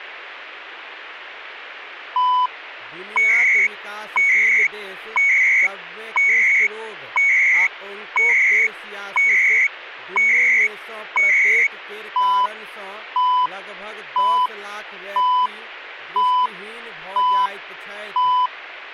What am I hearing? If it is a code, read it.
Radio time signal (CHU, Canada), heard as beeps and data bursts, one a second, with radio static and speech in Maithili.